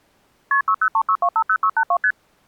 Multi-frequency trunk signalling (R1, as on North American trunks), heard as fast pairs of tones, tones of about 70 ms. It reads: KP 6036250682 ST